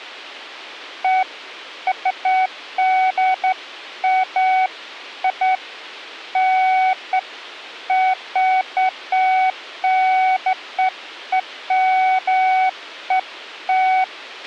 Beeps of irregular length, with a squelch burst at the end. There is no code.